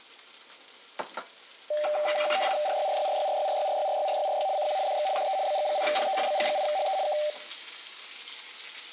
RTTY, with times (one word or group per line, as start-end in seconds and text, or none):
2.7-4.5 RYRYRYRYRYRYRYRYRY
4.6-4.8 CQ
4.9-5.1 DX
5.2-5.4 DE
5.5-6.2 BG8HE
6.3-7.0 BG8HE
7.1-7.2 K